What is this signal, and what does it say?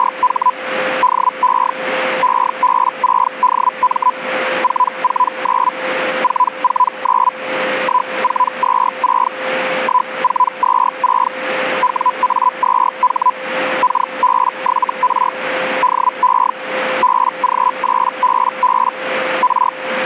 Hellschreiber (Feld-Hell, 122.5 baud), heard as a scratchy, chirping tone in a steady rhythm, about 1000 Hz, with radio static and a steady whistle near 520 Hz. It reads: … DE EB6DM 449 449 1426 1426 WA2H KB7R DE BG8BB R